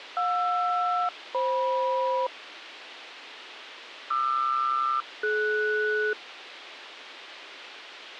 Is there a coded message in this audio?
Yes: aircraft SELCAL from 0.2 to 6.1 s, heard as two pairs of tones, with radio hiss. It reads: JR-FM QR-DS